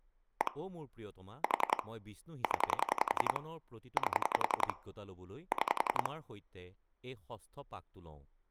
Pulse dialling, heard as clicks on a phone line, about 11 pulses a second, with speech in Assamese. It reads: 1 4 0 8 6